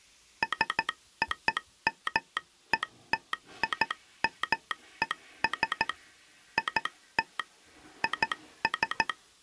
Morse code (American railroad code), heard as a telegraph sounder, hand-sent with a straight key, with the noise of a restroom. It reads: SOMETIMES IT IS